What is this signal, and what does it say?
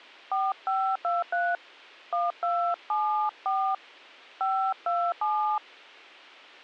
DTMF, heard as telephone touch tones, dialled by hand, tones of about 280 ms. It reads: 4523 1274 527